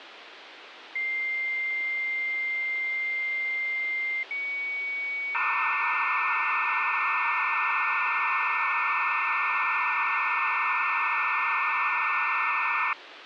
Dial-up modem handshake (low-speed, two carriers), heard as two whistles, then hiss, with phone line noise.